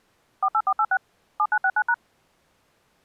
DTMF, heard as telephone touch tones, dialled by machine, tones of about 60 ms. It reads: 48486 7969#